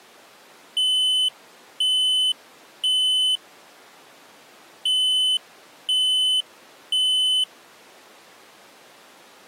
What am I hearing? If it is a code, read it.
Alarm pattern, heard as an alarm's beeps, played twice, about 3000 Hz. Temporal three. Smoke or fire, evacuate.